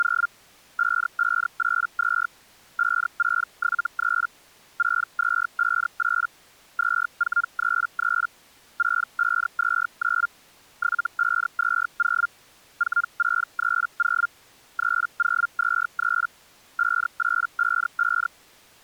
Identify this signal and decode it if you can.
Hellschreiber (Feld-Hell, 122.5 baud), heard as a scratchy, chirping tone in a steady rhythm, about 1400 Hz. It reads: … 5582 5673 6258 2433 6529 7520 4630 3023 5855